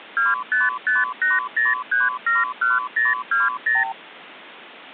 Multi-frequency trunk signalling (R2, with the far end's replies), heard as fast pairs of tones, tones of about 180 ms. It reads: 25580371020